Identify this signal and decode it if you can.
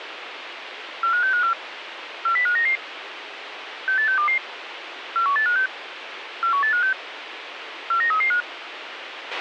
Five-tone selective call (CCIR), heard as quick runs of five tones, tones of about 100 ms, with radio hiss and a squelch burst at the end. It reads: 45654 40599 68622 41856 41856 49335